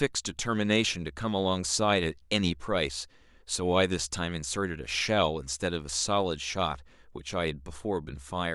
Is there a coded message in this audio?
No, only speech in English.